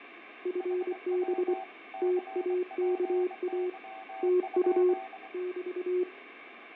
Morse code, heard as two keyed tones, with radio static, fading and room echo. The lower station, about 24 wpm, 360 Hz: FB TAKA TU <BT>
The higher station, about 23 wpm, 770 Hz: HW CPY?